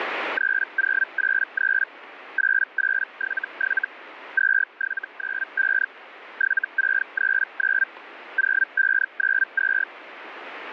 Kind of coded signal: Hellschreiber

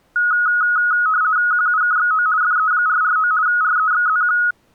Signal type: RTTY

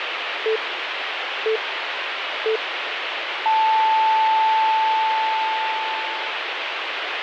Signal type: radio time signal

